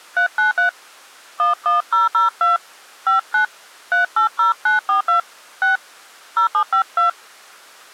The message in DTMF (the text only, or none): 393 11002 59 380942 6 0752